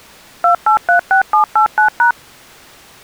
DTMF, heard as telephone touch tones, dialled by machine, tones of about 110 ms. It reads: 2836789#